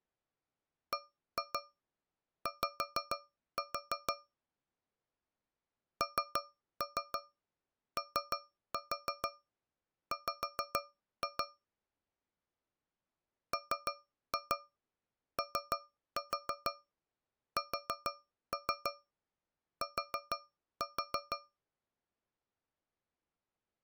Tap code, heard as taps on a metal pipe, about 6 knocks a second. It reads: BY NOW MOST